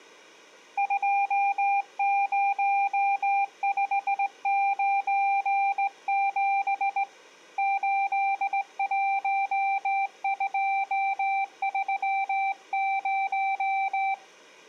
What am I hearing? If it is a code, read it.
Morse code, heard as a keyed tone, hand-sent with a straight key, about 18 wpm, 790 Hz. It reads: 20597 81230